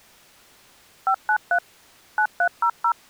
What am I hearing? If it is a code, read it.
DTMF, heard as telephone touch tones, dialled by machine, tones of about 80 ms. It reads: 593 9300